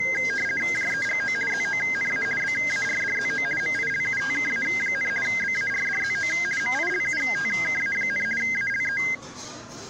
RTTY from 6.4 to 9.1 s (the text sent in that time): MILUTKA, ALE